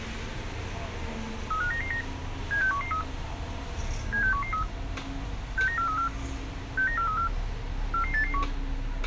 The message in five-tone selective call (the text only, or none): 35999 76113 76113 69434 69434 44881